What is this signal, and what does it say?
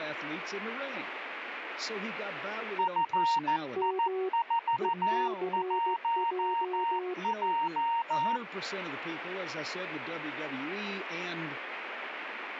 Morse code, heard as two keyed tones, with radio static and speech in English. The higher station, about 14 wpm, 930 Hz: FI41J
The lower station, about 16 wpm, 370 Hz: M ECJ